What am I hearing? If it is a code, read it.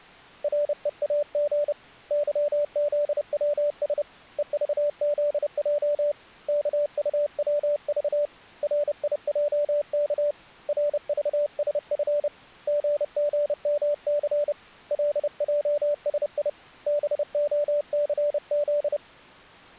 Morse code, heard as a keyed tone, hand-sent with a paddle, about 30 wpm, 590 Hz. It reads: REAG YZWS EVZJ KUWV RIJK RVSF GGMC LJSI BOCZ